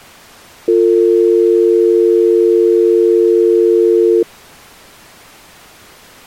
Telephone call progress tone (North American or UK plan), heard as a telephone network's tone, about 350, 450 Hz. Dial tone.